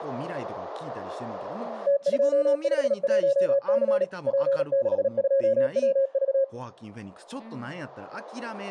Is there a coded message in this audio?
Yes: Morse code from 1.8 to 6.5 s, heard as a keyed tone, machine-sent, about 37 wpm, 550 Hz, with speech in Japanese. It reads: T251C P62WV